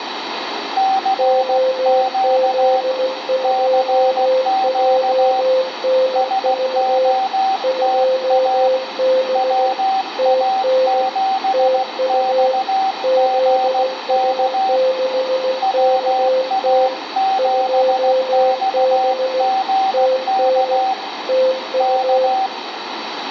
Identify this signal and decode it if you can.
Morse code, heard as two keyed tones, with radio static and room echo. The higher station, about 16 wpm, 770 Hz: CQ CQ SOTA WA7XGK WA7XGK K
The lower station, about 16 wpm, 520 Hz: OZ2JNV 2B TN TU ZS6KT 2B TN TU